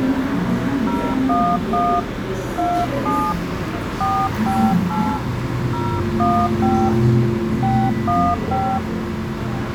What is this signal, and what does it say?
DTMF, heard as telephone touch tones, dialled by hand, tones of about 270 ms, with the noise of a cafe. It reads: 011 27 458 015 615